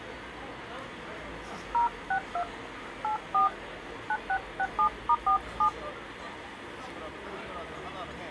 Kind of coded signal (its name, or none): DTMF